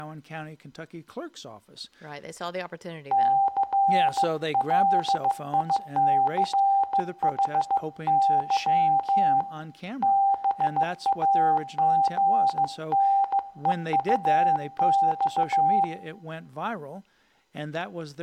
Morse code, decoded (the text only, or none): CLICHY BAGNEUX